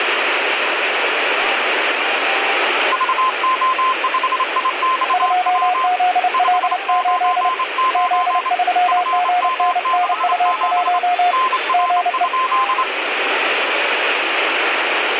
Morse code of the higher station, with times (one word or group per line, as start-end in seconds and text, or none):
2.9-5.9 VO5IXW
6.3-8.5 599
8.9-11.0 FM67
11.3-12.8 NR?